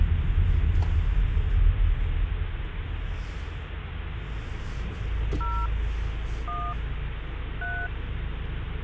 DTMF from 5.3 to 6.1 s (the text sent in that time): 0